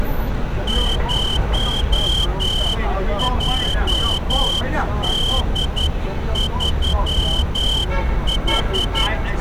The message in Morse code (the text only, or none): 0JD3H